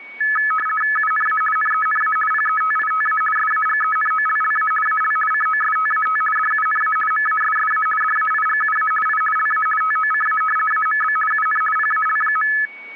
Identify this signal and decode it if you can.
RTTY (50 baud, 450 Hz shift), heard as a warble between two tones, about 1500 Hz centre, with static crashes and a steady whistle near 2240 Hz. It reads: UNA NENA PETITA SAGENOLLA AL COSTAT DUNA MASSA DAIGUA I LA TOCA AMB UN PAL.